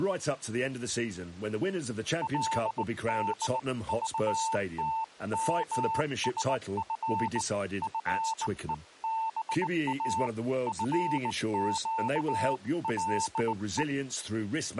Morse code (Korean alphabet), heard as a keyed tone, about 19 wpm, 890 Hz, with speech in English. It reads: 그러면 나도 내가